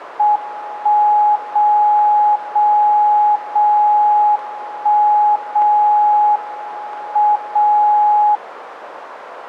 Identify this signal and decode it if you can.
Radio time signal (WWVB), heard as a tone whose level steps once a second, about 840 Hz, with radio static. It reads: 1 0 0 0 1 0 M 0